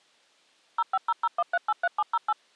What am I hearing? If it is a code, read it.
DTMF, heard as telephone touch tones, dialled by machine, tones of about 40 ms. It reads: 05001383708